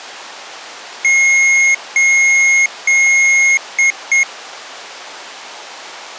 Beep code, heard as beeps from a small speaker, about 2150 Hz. 3 long, 2 short.